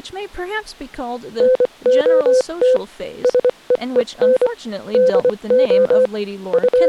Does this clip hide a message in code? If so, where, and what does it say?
Yes: Morse code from 1.3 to 6.9 s, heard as a keyed tone, machine-sent, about 24 wpm, spaced as for 21 wpm, 520 Hz, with speech in English. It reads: NOT SEEN DO …